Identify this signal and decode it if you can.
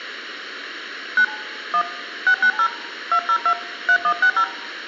DTMF, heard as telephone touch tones, dialled by hand, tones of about 80 ms. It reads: 9 1 690 202 3160